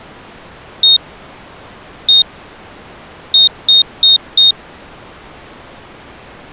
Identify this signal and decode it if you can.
Beep code, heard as a piezo beeper, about 3700 Hz. 1-1-4. In Phoenix BIOS tables: BIOS ROM checksum failure.